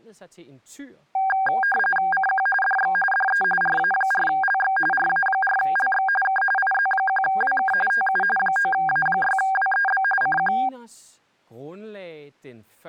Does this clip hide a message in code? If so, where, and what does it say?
Yes: RTTY (45.45 baud, 850 Hz shift) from 1.1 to 10.7 s, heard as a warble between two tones, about 1190 Hz centre, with speech in Danish. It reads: CQ DX DE RA4LX RA4LX K IZ1WK TU 9A6WEB CQ